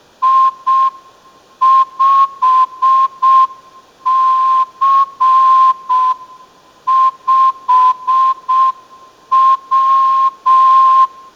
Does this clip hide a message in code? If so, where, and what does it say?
Yes: Morse code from 0.2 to 11.1 s, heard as a whistle, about 6 wpm. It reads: I5C5W